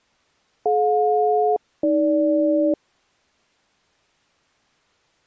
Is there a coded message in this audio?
Yes: aircraft SELCAL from 0.7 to 2.7 s, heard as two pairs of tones. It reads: DJ-AG